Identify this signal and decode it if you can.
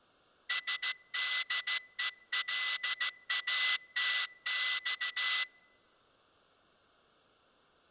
Morse code (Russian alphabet), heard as a whistle, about 14 wpm. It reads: СДЕЛАТЬ